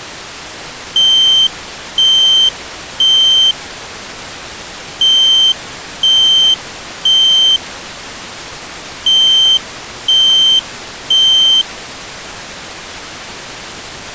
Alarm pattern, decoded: temporal three

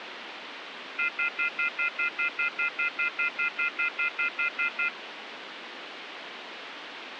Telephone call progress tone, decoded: off-hook warning tone

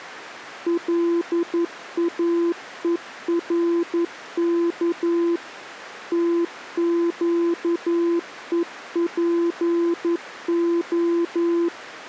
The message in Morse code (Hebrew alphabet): לאורך תקופה

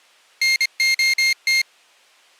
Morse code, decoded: NOT

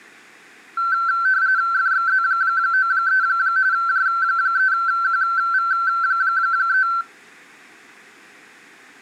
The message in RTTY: FXZ93 J3QV3

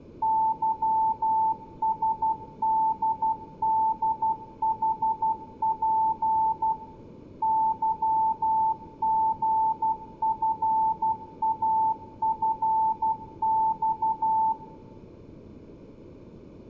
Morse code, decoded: YSDDHP YGFAFX

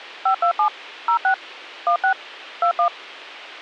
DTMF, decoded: 527 06 16 21

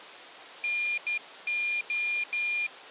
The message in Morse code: NO

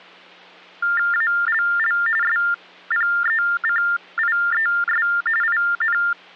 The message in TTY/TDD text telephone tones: ALL SPECIES IN

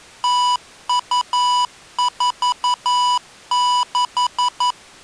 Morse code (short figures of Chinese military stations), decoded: 0246

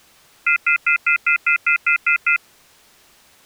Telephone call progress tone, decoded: off-hook warning tone

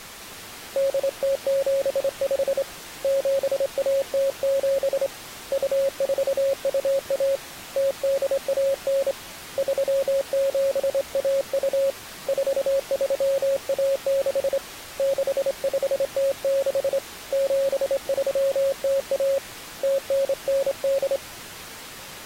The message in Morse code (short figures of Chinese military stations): 8075 7107 2421 0819 3712 4316 6506 7301 0998

